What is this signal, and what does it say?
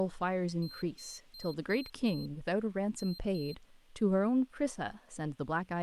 Beep code, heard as a piezo beeper, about 4150 Hz, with speech in English. 5-2.